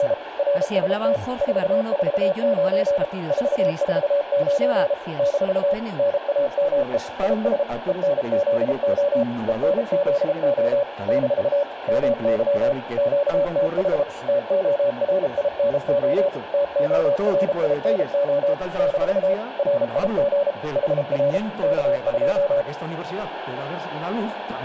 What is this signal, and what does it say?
Morse code, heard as a keyed tone, machine-sent, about 33 wpm, 570 Hz, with radio static and room echo. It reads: … RST 449 449 - NAME IS ENZO ENZO - MY QTH TORINO TORINO - RIG HR K2